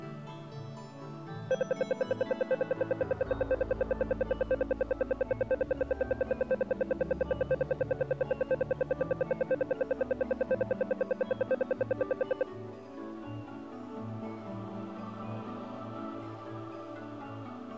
Radio time signal (RWM, Moscow), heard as ten pulses a second.